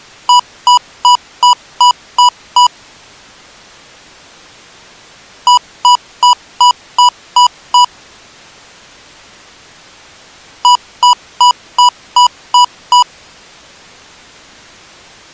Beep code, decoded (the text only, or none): 7 short